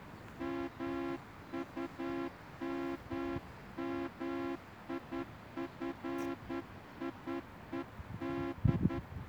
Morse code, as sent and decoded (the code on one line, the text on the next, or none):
-- ..- -- -- .. ..-. .. . -..
MUMMIFIED